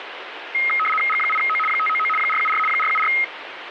RTTY (75 baud, 850 Hz shift), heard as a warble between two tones, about 1700 Hz centre, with radio static. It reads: G8O 599 474 474